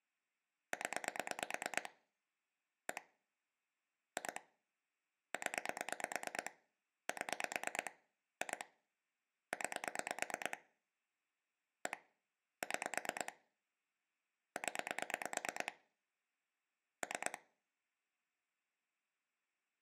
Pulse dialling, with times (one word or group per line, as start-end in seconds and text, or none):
0.7-1.9 0
2.9-3.0 1
4.2-4.4 2
5.3-6.5 0
7.1-7.9 7
8.4-8.6 2
9.5-10.6 9
11.9-12.0 1
12.6-13.3 6
14.6-15.7 0
17.0-17.4 3